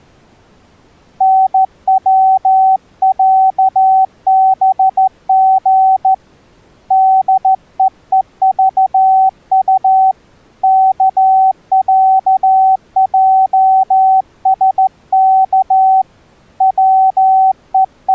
Morse code (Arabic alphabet), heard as a keyed tone, hand-sent with a straight key, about 14 wpm, 760 Hz. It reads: نوعبغ دءءضط كعجسك …